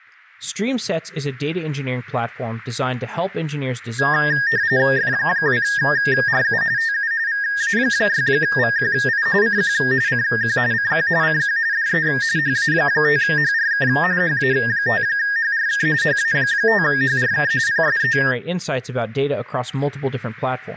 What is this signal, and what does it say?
RTTY (45.45 baud, 170 Hz shift), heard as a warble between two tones, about 1750 Hz centre, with speech in English. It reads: F2RU TU VA6VQI CQ CQ CQ CQ DE HA5HRK HA5HRK HA5HRK PSE